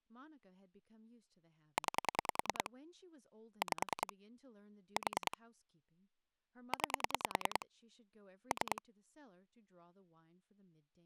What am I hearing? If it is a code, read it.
Pulse dialling, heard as clicks on a phone line, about 10 pulses a second, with speech in English. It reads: 9 5 4 9 3